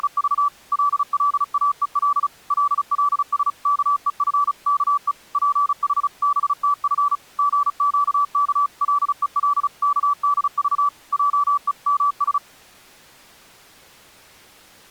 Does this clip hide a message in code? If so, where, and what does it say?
Yes: Morse code (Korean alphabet) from 0.0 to 12.4 s, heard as a keyed tone, machine-sent, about 35 wpm, 1150 Hz. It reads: … 꽉 껴안아 주던 생각을 하며